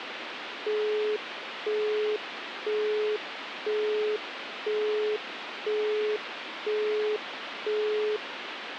Telephone call progress tone (single-tone plan, as in Europe, Japan and elsewhere), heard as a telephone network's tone, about 420 Hz, 0.5 s on and 0.5 s off, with phone line noise. Busy tone.